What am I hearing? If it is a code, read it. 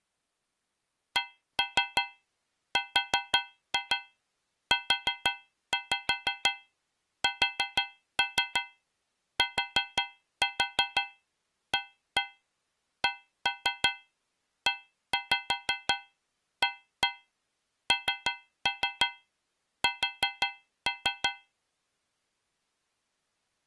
Tap code, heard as taps on a metal pipe, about 5 knocks a second. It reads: CRUSTACEANS